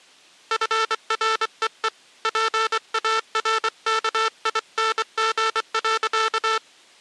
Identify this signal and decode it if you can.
Morse code, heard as a buzzer, hand-sent with a straight key, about 24 wpm. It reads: FREE PARKING.